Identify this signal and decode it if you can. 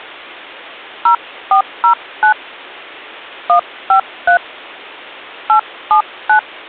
DTMF, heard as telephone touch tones, dialled by hand, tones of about 100 ms. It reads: 0409 153 879